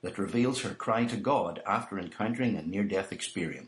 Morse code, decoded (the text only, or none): none